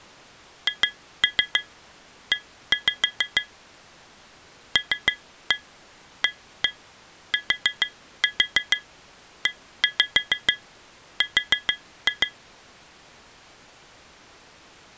Tap code, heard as taps on glass, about 6 knocks a second. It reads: HE LATER